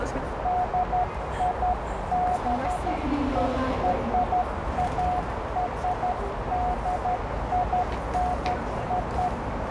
Morse code (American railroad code), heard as a keyed tone, hand-sent with a straight key, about 720 Hz, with heavy radio static, a narrow filter and the noise of a subway station. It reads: DIBERARDINO